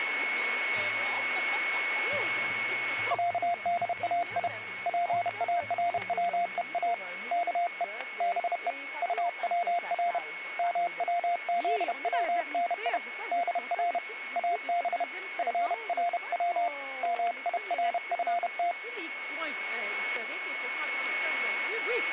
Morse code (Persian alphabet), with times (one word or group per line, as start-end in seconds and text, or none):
3.1-4.5 صدای
4.9-6.9 پاروها
7.3-7.8 که
8.2-8.7 به
9.0-10.2 طور
10.6-13.0 موزونی
13.3-14.0 در
14.4-15.0 اب
15.4-16.7 فرو
17.0-18.7 میرفت